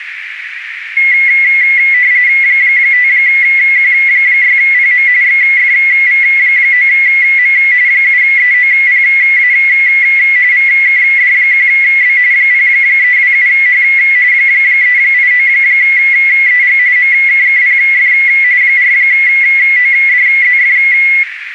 RTTY (45.45 baud, 170 Hz shift), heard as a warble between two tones, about 2050 Hz centre, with radio static and a narrow filter. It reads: 5Q6PM XFV9M 7EOPA VKD1B 0327H 389EG MKKPF 4ODZF